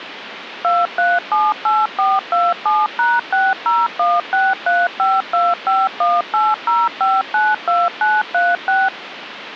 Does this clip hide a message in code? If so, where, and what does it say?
Yes: DTMF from 0.6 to 8.9 s, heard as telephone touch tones, dialled by machine, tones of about 200 ms, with phone line noise. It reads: 2378427#60163525180592936